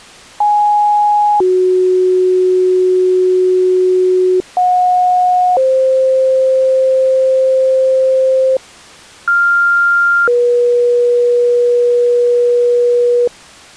Two-tone page, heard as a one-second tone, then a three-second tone, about 830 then 370 Hz, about 730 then 520 Hz, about 1400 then 480 Hz.